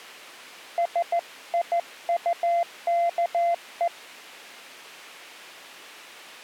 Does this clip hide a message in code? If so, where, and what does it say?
Yes: Morse code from 0.7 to 3.9 s, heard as a keyed tone, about 14 wpm, 690 Hz. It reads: SIUKE